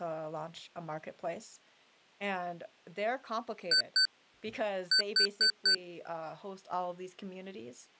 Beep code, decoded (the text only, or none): 2-4